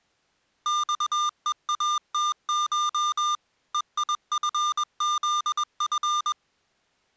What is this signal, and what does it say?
Morse code (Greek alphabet), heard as electronic beeps, machine-sent, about 21 wpm, 1200 Hz. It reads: ΞΕΑΤΧ ΕΙΦΖΦ